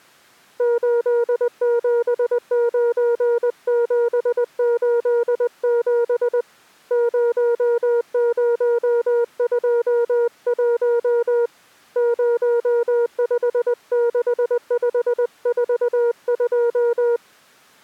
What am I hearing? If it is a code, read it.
Morse code, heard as a keyed tone, hand-sent with a paddle, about 20 wpm, 470 Hz. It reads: 879787 0021 056542